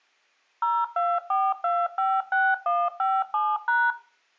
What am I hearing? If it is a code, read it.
DTMF, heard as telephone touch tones, dialled by machine, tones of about 230 ms. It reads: 024256157#